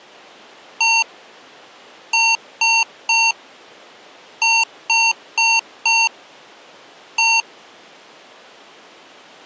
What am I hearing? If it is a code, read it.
Beep code, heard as beeps from a small speaker, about 910 Hz. 1-3-4-1. In Phoenix BIOS tables: memory failure on an address line.